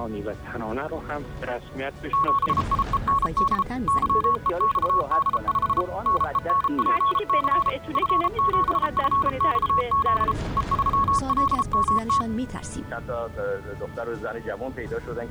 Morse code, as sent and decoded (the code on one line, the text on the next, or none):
--... .. . -. -.. / -.-- . -..- -.. ..... / -. . -. .--. -.-. / ..-. --... ..-. -..- --.. / . ...-- .-.. -- -
7IEND YEXD5 NENPC F7FXZ E3LMT